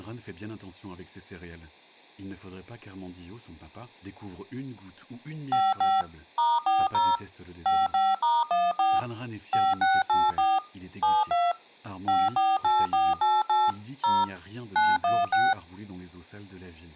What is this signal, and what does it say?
DTMF, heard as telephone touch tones, dialled by machine, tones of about 210 ms, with speech in French. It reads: 55 *40 55*14 5684 72 548488 0 916